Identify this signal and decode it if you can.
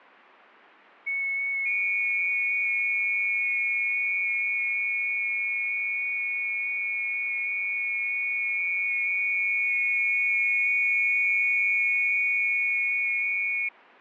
FT8 (several signals at once), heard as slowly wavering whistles, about 6.25 baud.